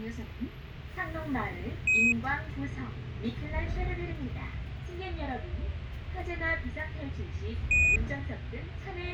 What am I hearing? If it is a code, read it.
Quindar tones, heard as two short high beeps, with a squelch burst at the end and the noise inside a bus.